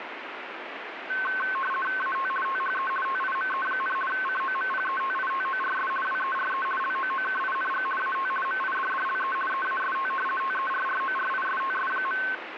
RTTY (50 baud, 450 Hz shift), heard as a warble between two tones, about 1300 Hz centre, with radio static. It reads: AT THE TIME, COMPETITORS WERE LOOKING AT MIDDLE EAST TERRORISTS.